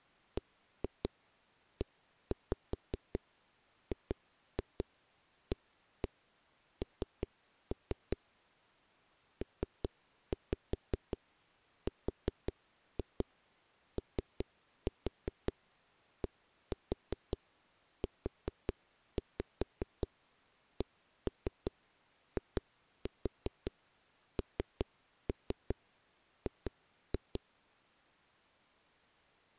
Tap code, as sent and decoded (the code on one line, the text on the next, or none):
1-2 1-5 2-2 1-1 3-3 / 3-5 4-2 3-4 1-4 4-5 1-3 2-4 3-3 2-2
BEGAN PRODUCING